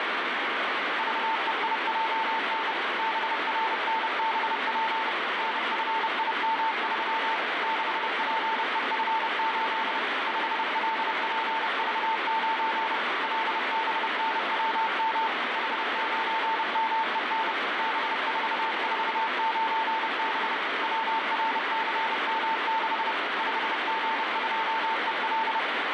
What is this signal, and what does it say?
Morse code, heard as a keyed tone, machine-sent, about 30 wpm, 900 Hz, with heavy radio static. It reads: VEIJN BRNBP NFIM3 6PEF8 5LPV9 LBNWM H9MEN B449B WRCM6 5G2EL